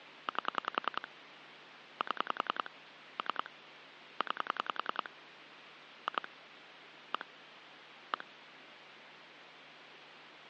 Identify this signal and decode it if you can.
Pulse dialling, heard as clicks on a phone line, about 10 pulses a second, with phone line noise. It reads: 8 7 3 9 2 1 1